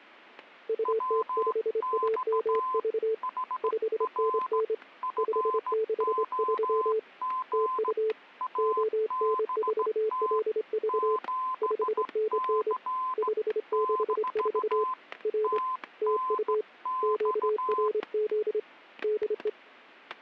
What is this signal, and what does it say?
Morse code, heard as two keyed tones, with static crashes. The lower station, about 26 wpm, 440 Hz: UT5AMV 5NN 563 TU ON4LV 5NN 564 R TU QRZ DE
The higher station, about 16 wpm, 1030 Hz: WX HR FOG ABT 7C - TNX